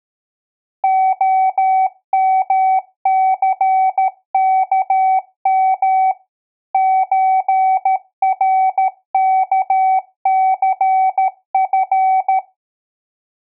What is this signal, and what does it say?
Morse code (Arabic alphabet), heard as a keyed tone, machine-sent, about 13 wpm, 760 Hz. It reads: خمثكم زركثف